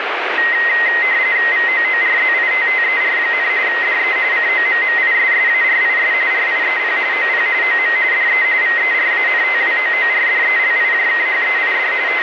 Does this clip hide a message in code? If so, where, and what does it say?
Yes: RTTY (45.45 baud, 170 Hz shift) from 0.4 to 12.2 s, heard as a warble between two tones, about 1950 Hz centre, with radio static. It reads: VOORZITTER, DE COMMISSARIS RIEP OP OM DE VERANTWOORDELIJKHEID …